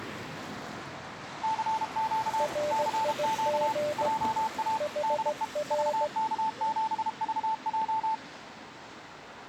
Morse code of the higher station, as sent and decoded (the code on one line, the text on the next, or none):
-.-. --.- / -.-. --.- / .--- .- / -.. . / ...- -.- --... ...- .---
CQ CQ JA DE VK7VJ